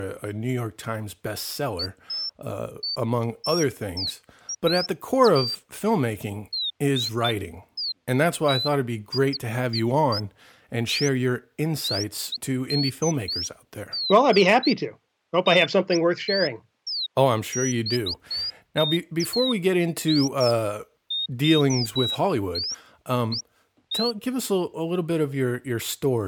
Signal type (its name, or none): none